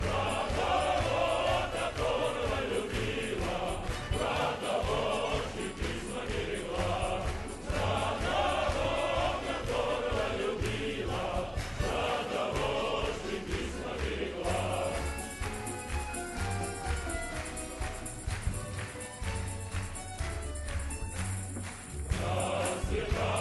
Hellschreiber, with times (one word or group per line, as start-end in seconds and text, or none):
none